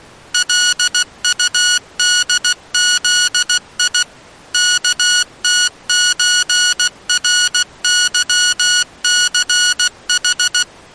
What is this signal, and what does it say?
Morse code (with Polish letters), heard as electronic beeps, machine-sent, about 16 wpm, 1460 Hz. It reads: LUDZI KTÓRYCH